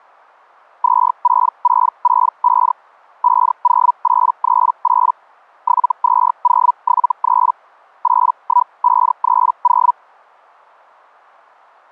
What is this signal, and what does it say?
Hellschreiber (Feld-Hell, 122.5 baud), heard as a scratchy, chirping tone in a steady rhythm, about 980 Hz. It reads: 26665 50838 72073 81530